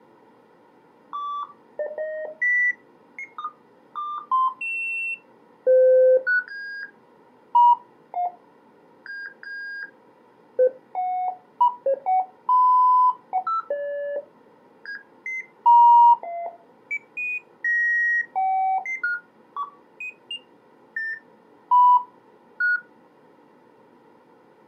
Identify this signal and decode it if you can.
Electronic bleeps of random pitch and length. There is no code.